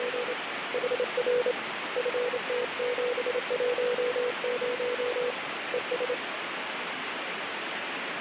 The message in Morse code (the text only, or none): … HR FT710 ES